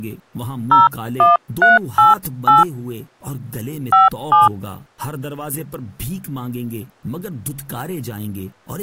DTMF, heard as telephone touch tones, dialled by hand, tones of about 160 ms. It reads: 01388 57